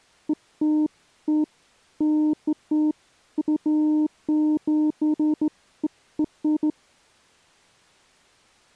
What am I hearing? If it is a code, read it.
Beeps of irregular length. There is no code.